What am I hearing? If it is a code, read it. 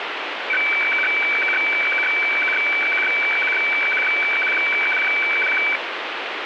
Weather fax (radiofax), 120 lines a minute, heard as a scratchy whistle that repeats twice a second, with radio static.